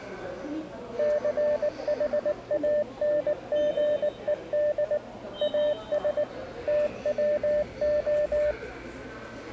Morse code, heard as a keyed tone, machine-sent, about 19 wpm, 600 Hz, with the noise of a subway station. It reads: CHANGED AS TWO